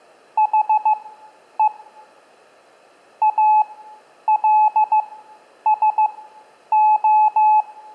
Morse code, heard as a keyed tone, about 15 wpm, spaced as for 9 wpm, 860 Hz, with room echo. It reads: HE ALSO